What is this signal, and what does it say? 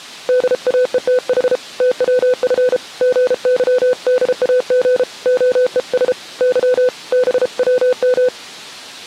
Morse code, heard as a keyed tone, hand-sent with a paddle, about 33 wpm, 500 Hz. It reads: DAETH TWF GYDAG OES Y BWM